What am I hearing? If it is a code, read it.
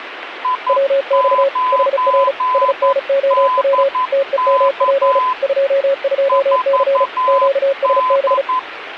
Morse code, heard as two keyed tones, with radio static. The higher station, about 11 wpm, 1010 Hz: I9DK 4D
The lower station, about 35 wpm, 550 Hz: WX HR SNOW TEMP 22C QSB